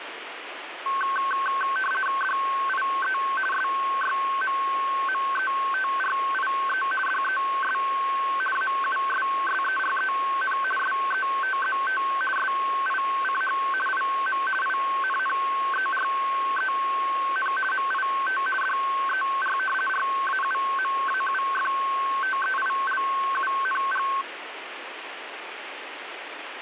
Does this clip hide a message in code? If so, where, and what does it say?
Yes: RTTY (50 baud, 450 Hz shift) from 0.9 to 24.2 s, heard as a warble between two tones, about 1310 Hz centre, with radio static. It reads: DIE SYMMETRIE DES AUSSEREN SETZT SICH IM INNEREN MIT DER RAUMAUFTEILUNG